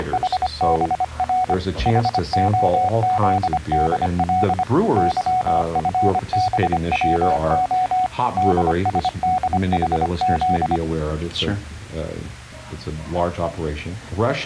Morse code (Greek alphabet), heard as a keyed tone, hand-sent with a paddle, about 25 wpm, 740 Hz. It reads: … ΗΟΖΔΛ ΥΦΒΩΟ ΔΣΔΗΖ